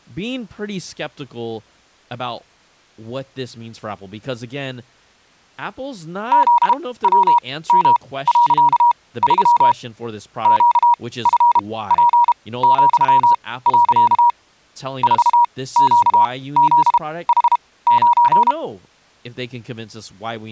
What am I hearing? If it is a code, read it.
Morse code, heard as a keyed tone, machine-sent, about 32 wpm, spaced as for 19 wpm, 960 Hz, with speech in English. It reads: ZWM.3 QFP,. 4QZH9